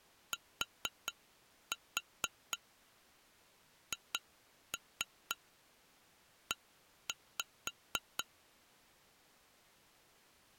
Tap code, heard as taps on glass, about 4 knocks a second. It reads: THE